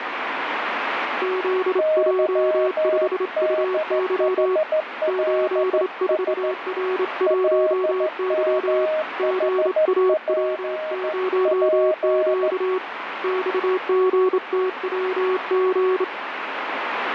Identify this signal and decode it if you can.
Morse code, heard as two keyed tones, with radio static. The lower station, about 27 wpm, 370 Hz: ZJ5UY 84R1Y GAW0Q XGTWG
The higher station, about 14 wpm, 620 Hz: YDHLS LMHPP